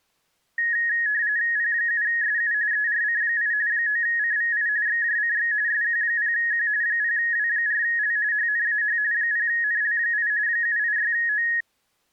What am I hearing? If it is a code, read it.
RTTY (45.45 baud, 170 Hz shift), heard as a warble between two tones, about 1800 Hz centre. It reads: P7SU ERC8 9CVI XJCX SQ0Q 0W4L HNAH 0NL8 786O